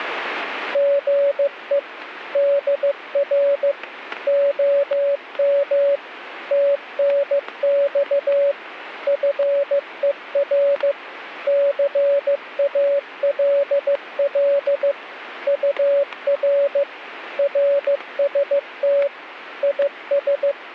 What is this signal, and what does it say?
Morse code, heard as a keyed tone, machine-sent, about 15 wpm, 560 Hz, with static crashes. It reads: GE DR OM TNX FER CALL UR RST IS